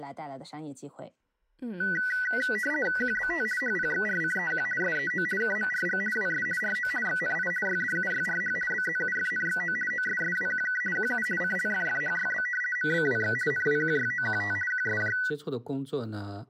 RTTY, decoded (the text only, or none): QBT HPXRCEQ SEO KMRG WS RO XNI YDUYRH BZUFNXO OSSWQK QU CLFFHYB MBWX NWQYOQT QSJ